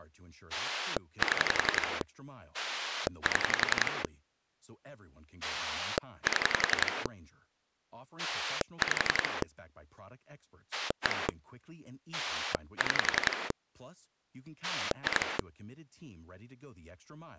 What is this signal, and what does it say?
Pulse dialling, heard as a rotary dial, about 11 pulses a second, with speech in French. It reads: 7 7 7 5 1 6 2